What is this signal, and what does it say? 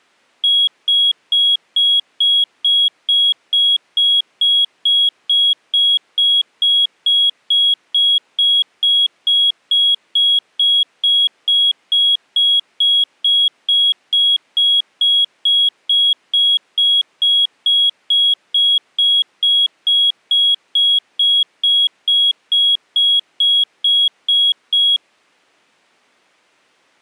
Evenly repeated beeps. There is no code.